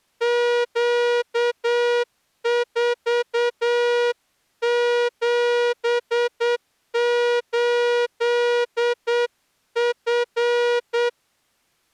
Morse code, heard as a horn, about 8 wpm. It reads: Q478F